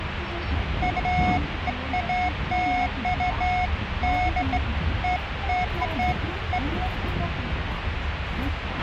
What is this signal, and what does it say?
Beeps of irregular length, with radio hiss, a squelch burst at the end and the noise inside a bus. There is no code.